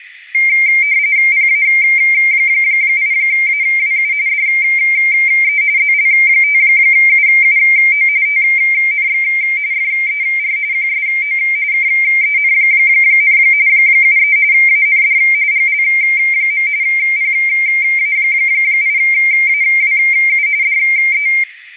RTTY (45.45 baud, 170 Hz shift), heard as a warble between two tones, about 2200 Hz centre, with radio static and room echo. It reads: PA8AWU DE ZL5UUO TNX FER QSO KEN, 73 AND GL. PA8AWU DE